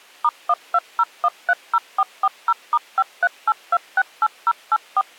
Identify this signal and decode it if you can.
DTMF, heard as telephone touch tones, dialled by machine, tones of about 50 ms. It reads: *120130440*538268084